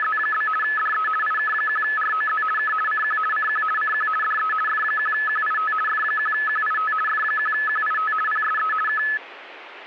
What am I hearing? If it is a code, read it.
RTTY (50 baud, 450 Hz shift), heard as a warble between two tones, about 1500 Hz centre. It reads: … DE IK1ROZ K CQ CQ CQ DE F1QIT F1QIT F1QIT PSE K